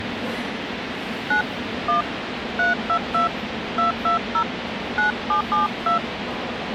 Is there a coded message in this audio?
Yes: DTMF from 1.3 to 6.0 s, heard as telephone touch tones, dialled by hand, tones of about 110 ms, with radio hiss and the noise of a subway station. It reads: 9 1 322 220 9772